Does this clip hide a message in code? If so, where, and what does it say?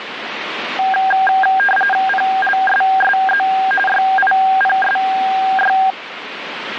Yes: RTTY (45.45 baud, 850 Hz shift) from 0.8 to 5.9 s, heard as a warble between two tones, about 1190 Hz centre, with radio static. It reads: PLSSZ YIPSY